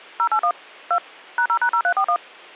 DTMF, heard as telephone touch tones, dialled by machine, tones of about 80 ms. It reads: 081 2 #0#0341